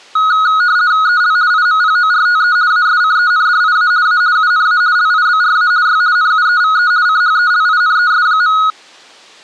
RTTY (50 baud, 170 Hz shift), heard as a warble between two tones, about 1360 Hz centre. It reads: EL IMPORTE ASCENDIA A UNA LIBRA Y NUEVE CHELINES.